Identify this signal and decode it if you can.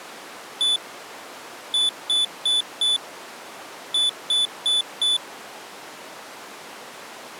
Beep code, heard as a piezo beeper, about 3500 Hz. 1-4-4.